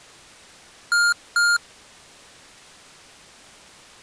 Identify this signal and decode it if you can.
Beep code, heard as beeps from a small speaker, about 1410 Hz. 2 short. In AMI BIOS tables: memory parity error; in IBM BIOS tables: self-test error shown on screen; in Dell tables: no memory detected.